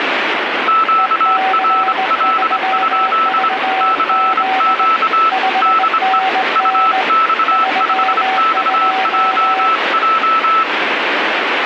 Morse code, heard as two keyed tones, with radio static. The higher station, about 25 wpm, 1320 Hz: QRL? CQ DE UX5XJJ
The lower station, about 19 wpm, 760 Hz: EC3VZ 5NN 32